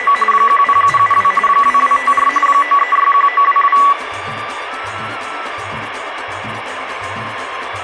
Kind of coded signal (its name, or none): RTTY